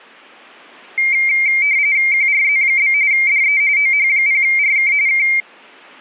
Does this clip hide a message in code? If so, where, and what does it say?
Yes: RTTY (45.45 baud, 170 Hz shift) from 1.0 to 5.4 s, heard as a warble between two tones, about 2200 Hz centre. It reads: QRZ? DE OH0RK K